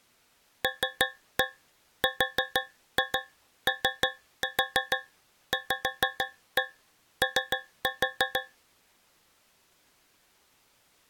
Tap code, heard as taps on a metal pipe, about 6 knocks a second. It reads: LROVO